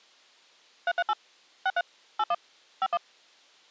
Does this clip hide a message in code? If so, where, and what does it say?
Yes: DTMF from 0.9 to 3.0 s, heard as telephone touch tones, dialled by machine, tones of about 50 ms. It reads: 338 63 81 51